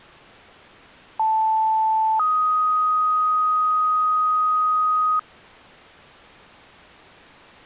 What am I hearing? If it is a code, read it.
Two-tone page, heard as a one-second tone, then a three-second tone, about 880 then 1250 Hz.